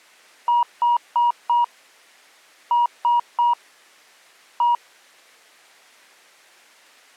Beep code, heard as beeps, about 960 Hz. 4-3-1. In Phoenix BIOS tables: memory failure above the first 64 KB.